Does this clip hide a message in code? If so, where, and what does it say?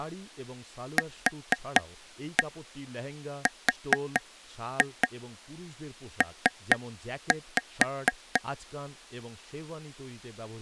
Yes: tap code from 1.0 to 8.4 s, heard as taps on a table, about 4 knocks a second, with speech in Bangla. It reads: QRP